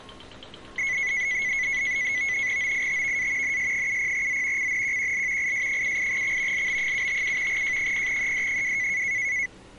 NAVTEX (SITOR-B), 100 baud, 170 Hz shift, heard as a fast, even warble, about 2100 Hz centre, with street noise. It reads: OITVA NS70Z CNQQL IS78X LB757 J0ED2